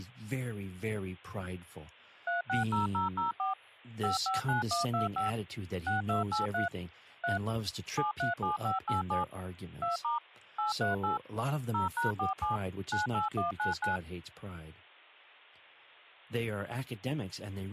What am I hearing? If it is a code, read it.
DTMF, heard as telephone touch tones, dialled by machine, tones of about 140 ms, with speech in English. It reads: 360004 559125 6283 3 737587 2* 838 0#47 98199